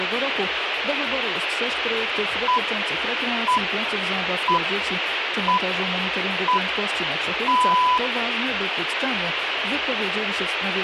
Radio time signal (six pips, as the Greenwich Time Signal), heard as pips, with radio hiss.